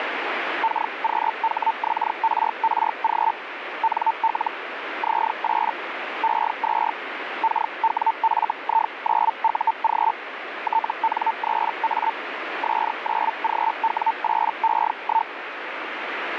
Hellschreiber (Feld-Hell, 122.5 baud), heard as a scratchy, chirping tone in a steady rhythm, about 900 Hz, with radio static. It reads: KQHXRRG NL Z8 E2 KWFI9UG TN3A S9GW8E1